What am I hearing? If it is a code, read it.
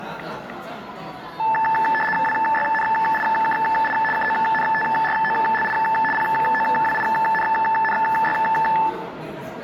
RTTY (75 baud, 850 Hz shift), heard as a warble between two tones, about 1310 Hz centre, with static crashes, room echo and the noise of a restaurant. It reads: WYNIKI KONTROLI POWINNY